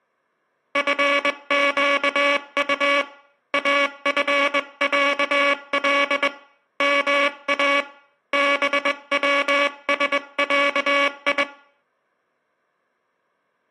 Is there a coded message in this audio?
Yes: Morse code (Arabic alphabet) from 0.7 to 11.5 s, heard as a buzzer, hand-sent with a straight key, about 21 wpm. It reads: فقط افعل ما بوسعي